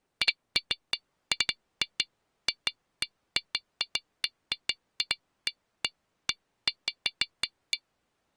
Irregular taps on glass. There is no code.